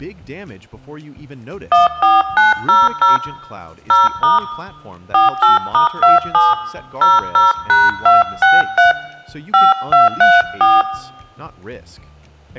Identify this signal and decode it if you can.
DTMF, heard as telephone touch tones, dialled by hand, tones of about 160 ms, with room echo. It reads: 14900 0* 48*27 00#263 5234